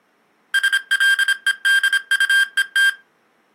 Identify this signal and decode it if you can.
Morse code (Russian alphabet), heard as electronic beeps, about 26 wpm, 1600 Hz. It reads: СЛЕДУЕТ